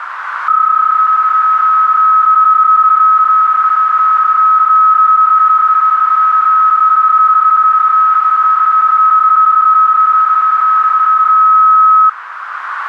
PSK31 (31.25 baud), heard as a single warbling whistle, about 1280 Hz, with radio static and a narrow filter.